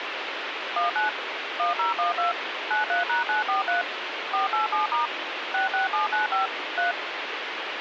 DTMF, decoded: 19 1012 93#943 487* 66795 3

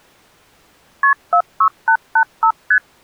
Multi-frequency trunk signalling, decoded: KP 46885 ST

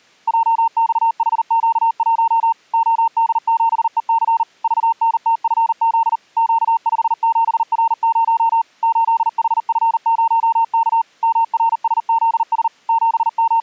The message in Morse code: JXHQ1 OD7EC VNTFZ Q57R0 8HF0K MRSZS …

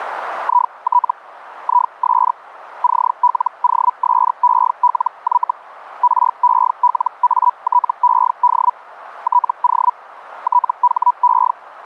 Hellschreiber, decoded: IT IS CLOSELY RELATED TO THE

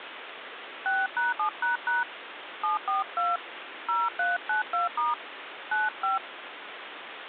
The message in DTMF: 6#7## 742 0392* 95

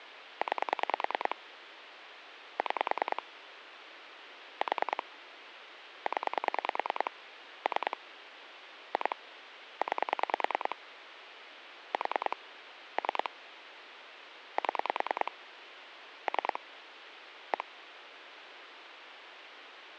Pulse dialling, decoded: 9 6 4 0 3 2 9 4 3 7 3 1

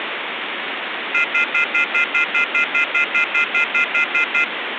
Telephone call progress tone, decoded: off-hook warning tone

